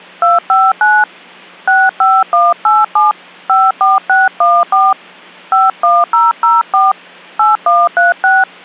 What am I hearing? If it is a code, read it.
DTMF, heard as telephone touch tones, dialled by hand, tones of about 190 ms. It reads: 259 65187 54614 51004 8136